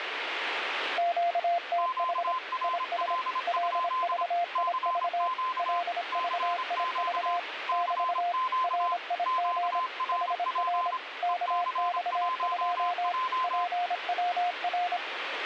Morse code, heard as two keyed tones, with radio static. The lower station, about 26 wpm, 700 Hz: QTH IS LVIV LVIV <BT> RIG HR KX2 PWR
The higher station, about 26 wpm, 1030 Hz: QRL? CQ CQ CQ QRP EC1J